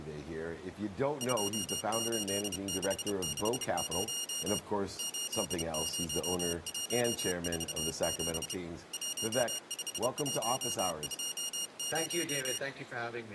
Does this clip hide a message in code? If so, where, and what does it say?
Yes: Morse code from 1.1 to 12.6 s, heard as a high beeper, hand-sent with a bug key, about 30 wpm, 2850 Hz. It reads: 28660 80147 15120